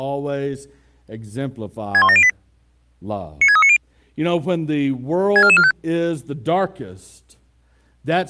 Five-tone selective call (ZVEI), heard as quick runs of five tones, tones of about 70 ms, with speech in English. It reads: 61708 96390 64445